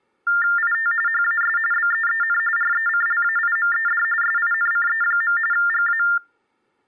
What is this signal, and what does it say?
TTY/TDD text telephone tones (45.45 baud Baudot), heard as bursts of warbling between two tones, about 400 Hz shift, 1600 Hz centre. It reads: IT HAS BEEN RECLAIMED SINCE. GA